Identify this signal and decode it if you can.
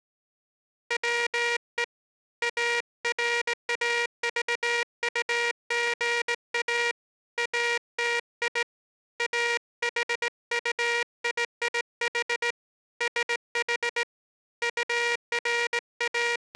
Morse code, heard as a buzzer, hand-sent with a straight key, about 18 wpm. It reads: WE ARAVUGA ATI AHUIIH SH …